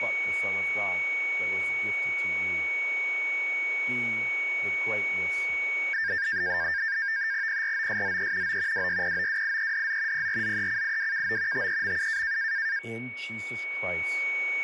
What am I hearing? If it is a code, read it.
NAVTEX (SITOR-B), 100 baud, 170 Hz shift, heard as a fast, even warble, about 1700 Hz centre, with a steady whistle near 2240 Hz and speech in English. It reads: PROSZE O WYPOWIEDZ PRZECIWKO TEMU